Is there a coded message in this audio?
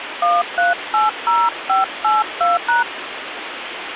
Yes: DTMF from 0.2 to 2.8 s, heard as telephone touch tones, dialled by hand, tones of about 160 ms, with phone line noise. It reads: 1380582#